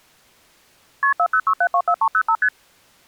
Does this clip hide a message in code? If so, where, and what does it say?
Yes: multi-frequency trunk signalling (R1, as on North American trunks) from 1.0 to 2.5 s, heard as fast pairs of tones, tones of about 70 ms. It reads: KP 406724305 ST